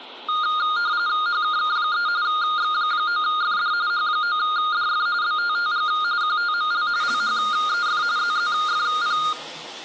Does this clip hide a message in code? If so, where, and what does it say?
Yes: RTTY (45.45 baud, 170 Hz shift) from 0.3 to 9.3 s, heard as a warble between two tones, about 1320 Hz centre, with the noise of a restroom. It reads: HKK3 X9FD H9DF BTTG QTML LHEF ZZFP